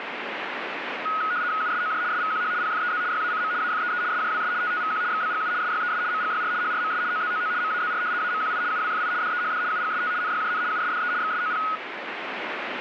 RTTY (75 baud, 170 Hz shift), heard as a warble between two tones, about 1360 Hz centre, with radio static. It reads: USOJ SVQH PFEZ YACM AFEE SJWS TTVQ XBGU SYES MGYR HRMS OZOO MAZR AMQI UWFI DEHD UGST NYJN USDE XSOP